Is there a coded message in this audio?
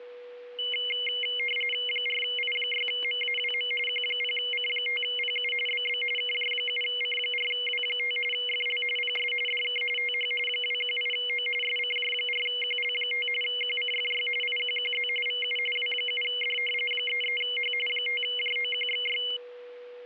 Yes: RTTY (45.45 baud, 850 Hz shift) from 0.6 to 19.4 s, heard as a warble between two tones, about 2550 Hz centre, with static crashes and a steady whistle near 490 Hz. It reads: 4I6MAWM Q0C5PU BB KJ7C4W5 FL PS DK TH 218O SCJ4QL5 QCFY IQQZ VU W7D 33H 5JOQXY